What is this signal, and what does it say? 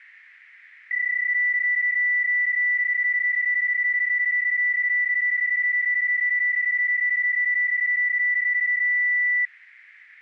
PSK31 (31.25 baud), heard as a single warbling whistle, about 1950 Hz.